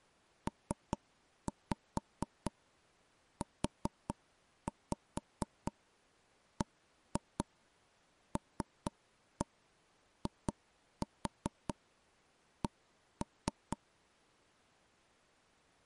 Tap code, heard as knocks on wood, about 4 knocks a second. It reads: PUBLIC